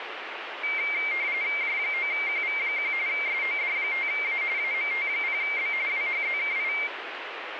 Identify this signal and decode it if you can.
RTTY (45.45 baud, 170 Hz shift), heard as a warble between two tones, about 2200 Hz centre, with radio static. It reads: J9QV1 SOD5A AMT0B WHZKI